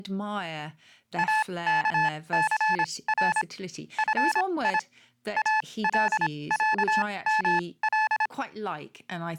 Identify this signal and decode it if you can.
Morse code (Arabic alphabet), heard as electronic beeps, machine-sent, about 26 wpm, spaced as for 20 wpm, 870 Hz, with speech in English. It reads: اكثر في العمل